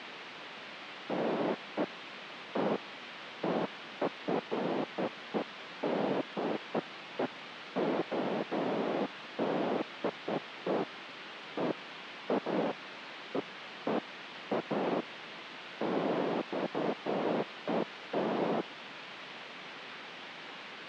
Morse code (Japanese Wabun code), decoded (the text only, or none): none